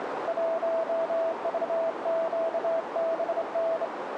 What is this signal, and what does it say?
Morse code, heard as a keyed tone, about 26 wpm, 660 Hz, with radio static and a narrow filter. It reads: 1VQBN